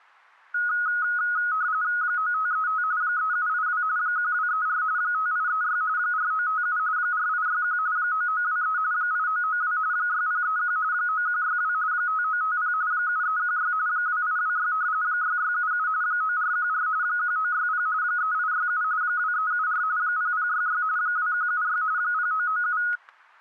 RTTY (45.45 baud, 170 Hz shift), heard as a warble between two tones, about 1360 Hz centre, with static crashes. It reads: 9535 3782 1234 5836 4957 4861 9923 8992 6031 9162 5950 7316 2826 6677 9414 1960 3867 2374 0066 2176 0997